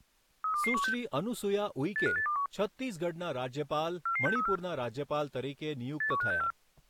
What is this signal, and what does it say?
Five-tone selective call (CCIR), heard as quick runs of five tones, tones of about 100 ms, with speech in Gujarati. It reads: 32216 85821 44634 81564